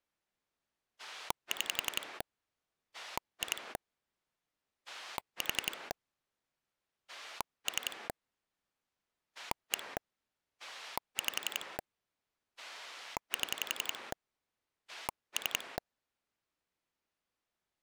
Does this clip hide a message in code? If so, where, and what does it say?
Yes: pulse dialling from 1.0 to 15.8 s, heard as a rotary dial, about 11 pulses a second. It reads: 6 2 4 3 1 5 7 3